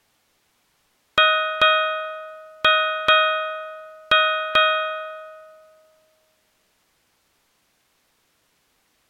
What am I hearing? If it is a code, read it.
Ship's bell, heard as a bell. 6. Six half-hours of the watch have passed.